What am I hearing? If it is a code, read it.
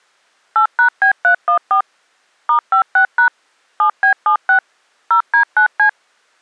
DTMF, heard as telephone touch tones, dialled by machine, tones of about 100 ms. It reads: 8#B314 *56# 7B76 0D9C